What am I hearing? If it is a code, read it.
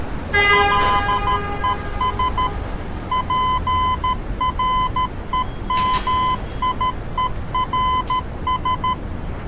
Morse code, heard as a keyed tone, machine-sent, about 13 wpm, 1020 Hz, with street noise. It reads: LES PREMIERS